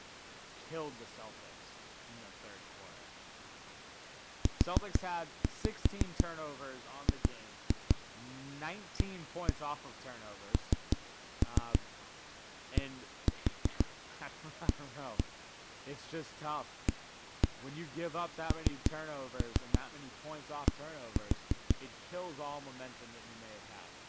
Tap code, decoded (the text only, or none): UGANDA AND